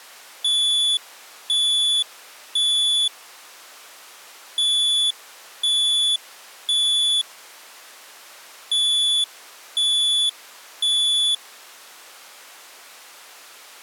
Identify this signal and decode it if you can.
Alarm pattern, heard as an alarm's beeps, played three times, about 3450 Hz. Temporal three. Smoke or fire, evacuate.